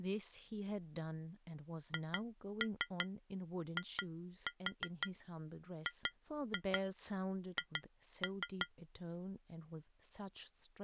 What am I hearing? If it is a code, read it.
Tap code, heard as taps on glass, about 5 knocks a second, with speech in English. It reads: HIGH